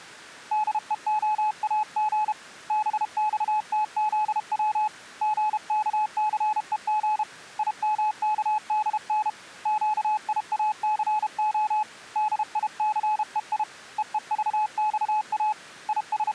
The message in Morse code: DEOAG BXTZW GKCEG IMKDN QIACO DICEI EEVXA …

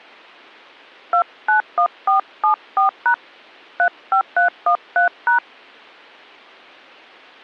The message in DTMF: 291474# 35313#

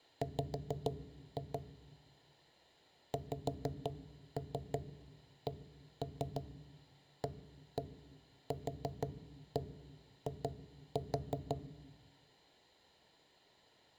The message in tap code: W XCAQI

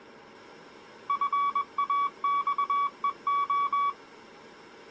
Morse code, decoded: FAXEO

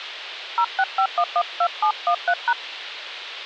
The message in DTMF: 065112713#

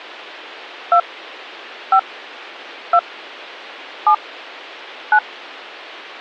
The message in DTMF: 2 5 2 7 9

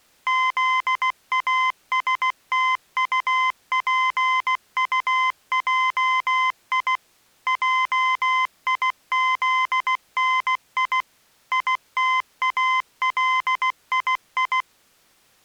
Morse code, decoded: ZASTUPUJI JIZNI ITALII

